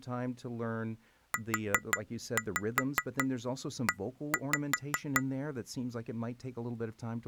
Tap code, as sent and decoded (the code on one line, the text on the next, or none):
4-5 1-5
UE